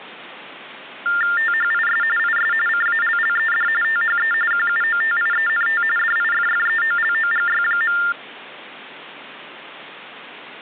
TTY/TDD text telephone tones (45.45 baud Baudot), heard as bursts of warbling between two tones, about 400 Hz shift, 1600 Hz centre. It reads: THIS IS CALLED THE QUOTIENT DIFFEOLOGY.